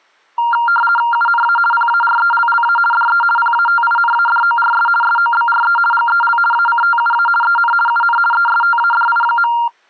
RTTY (50 baud, 450 Hz shift), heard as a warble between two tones, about 1170 Hz centre. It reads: UNA PARELLA DE PATINADORS SOBRE GEL ACTUA EN UN ESTADI.